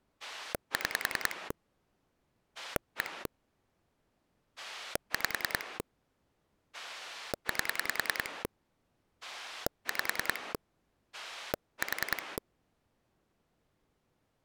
Pulse dialling, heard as a rotary dial, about 10 pulses a second. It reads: 6 1 5 8 5 4